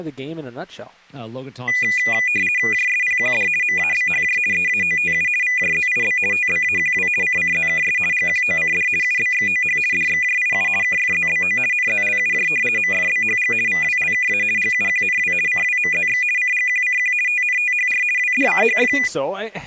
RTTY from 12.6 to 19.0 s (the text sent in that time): MFBHG VWLKA GUQNW CWMZX CGQCQ TNTHR WDCHF